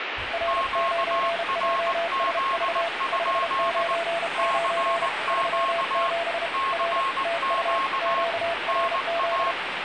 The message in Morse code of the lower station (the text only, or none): R9JSV 599 37 R TU QRZ